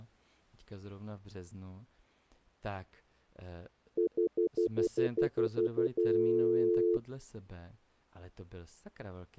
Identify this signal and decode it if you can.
Telephone call progress tone (North American plan), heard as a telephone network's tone, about 350, 440 Hz, 0.1 s on and 0.1 s off, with speech in Czech. Stutter dial tone.